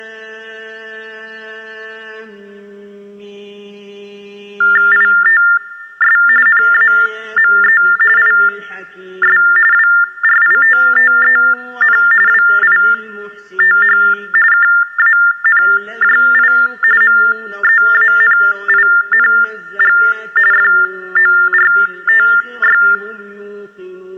TTY/TDD text telephone tones (45.45 baud Baudot), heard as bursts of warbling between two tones, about 400 Hz shift, 1600 Hz centre. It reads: ITS NAME IS WRITTEN WITH KANJI MEANING FORTY